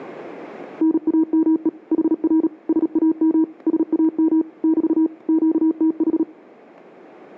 Morse code, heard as a keyed tone, machine-sent, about 37 wpm, 320 Hz. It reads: NAME HR SAM SAM <BT> QTH